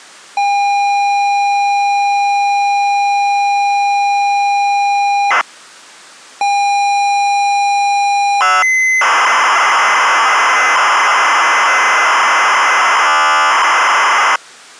ZX Spectrum tape loading, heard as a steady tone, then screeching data.